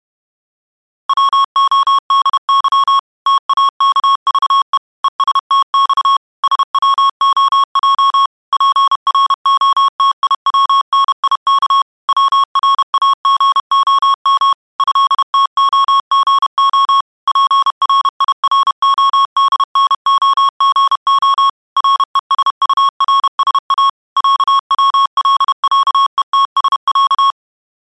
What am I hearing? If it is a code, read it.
Morse code (Russian alphabet), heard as electronic beeps, machine-sent, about 31 wpm, 1100 Hz. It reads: ВОДЫ ТАКЖЕ ЕСТЬ СВОЙ ПРОТИВНИК ВРАГОМ ЭТОГО ПРИРОДНОГО РЕСУРСА ЯВЛЯЕТСЯ